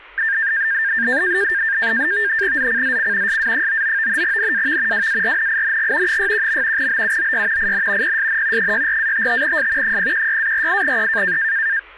NAVTEX (SITOR-B), 100 baud, 170 Hz shift, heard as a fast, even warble, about 1700 Hz centre, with speech in Bangla. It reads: ZCZC SA99 NAV WARNING 61. BUOY IN PSN 64-55S 016-48E